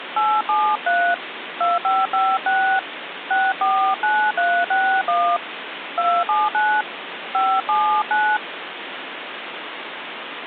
DTMF, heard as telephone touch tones, dialled by hand, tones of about 250 ms, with phone line noise. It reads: 873 2556 649361 279 579